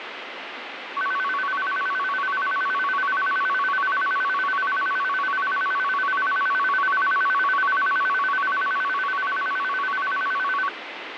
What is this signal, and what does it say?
A tone that alternates evenly between two pitches, with radio static. There is no code.